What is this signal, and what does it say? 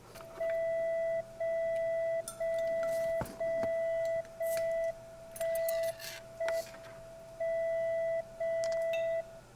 Radio time signal (JJY), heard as a tone whose level steps once a second, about 660 Hz, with the noise of a restaurant. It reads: 0 0 0 0 1 1 M 0 0